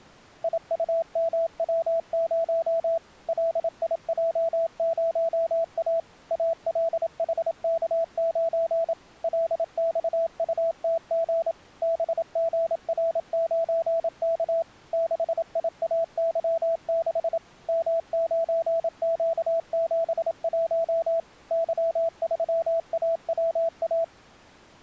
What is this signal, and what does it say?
Morse code, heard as a keyed tone, machine-sent, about 27 wpm, 660 Hz. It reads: IUMW0 LIJ0A ALHK9 LXUTG BGR9K 6IAY6 M9Q71 Y3AWA